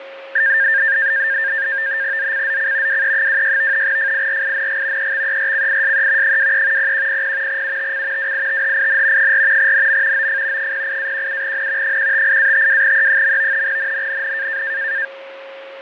NAVTEX (SITOR-B), 100 baud, 170 Hz shift, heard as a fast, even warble, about 1700 Hz centre, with radio static, fading and a steady whistle near 540 Hz. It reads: ZCZC WE26 FIRING EXERCISE 23 0100 UTC WITHIN 4 NM OF 08-17N 158-52E. NNNN